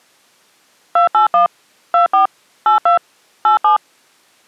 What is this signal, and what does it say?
DTMF, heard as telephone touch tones, dialled by machine, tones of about 120 ms. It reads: 281 24 82 87